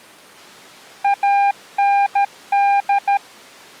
Morse code, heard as a keyed tone, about 13 wpm, 800 Hz. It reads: AND